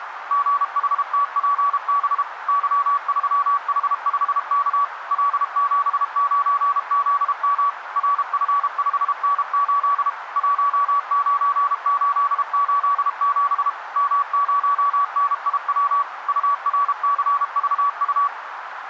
Morse code, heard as a keyed tone, machine-sent, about 32 wpm, 1140 Hz, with radio static and a narrow filter. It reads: GHTPB Y3H5K L79ZM RF5N8 19887 M0NIW URCVU